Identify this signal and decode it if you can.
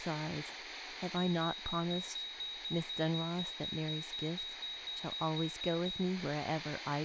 Evenly repeated beeps, with radio static, room echo and speech in English. There is no code.